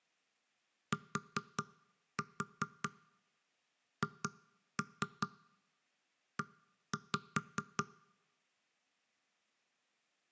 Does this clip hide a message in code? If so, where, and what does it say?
Yes: tap code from 0.9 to 7.9 s, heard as knocks on wood, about 4 knocks a second. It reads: THE